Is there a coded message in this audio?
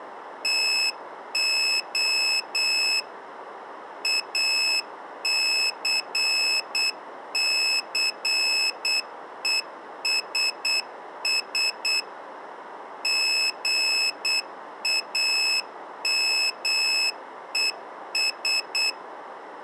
Yes: Morse code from 0.4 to 19.0 s, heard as a high beeper, machine-sent, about 8 wpm, 2600 Hz. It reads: TO ACCESS GAMES